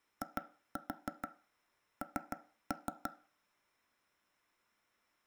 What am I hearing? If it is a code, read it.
Tap code, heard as taps on a table, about 6 knocks a second, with room echo. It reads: IN